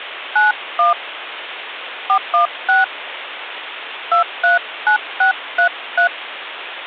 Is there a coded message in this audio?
Yes: DTMF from 0.4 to 6.1 s, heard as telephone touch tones, dialled by hand, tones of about 130 ms, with phone line noise. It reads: 91 416 239633